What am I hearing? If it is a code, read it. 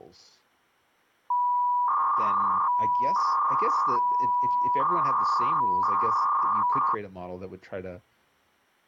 300-baud modem data (V.21 tones), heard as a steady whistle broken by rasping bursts, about 300 baud, 200 Hz shift, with speech in English.